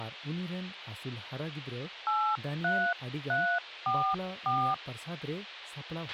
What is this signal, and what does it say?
DTMF, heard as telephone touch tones, dialled by hand, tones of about 280 ms, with a squelch burst at the end and speech in Santali. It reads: 83344